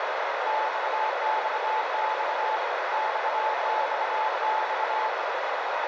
Morse code, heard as a keyed tone, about 25 wpm, 870 Hz, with heavy radio static and a narrow filter. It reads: XXX XXX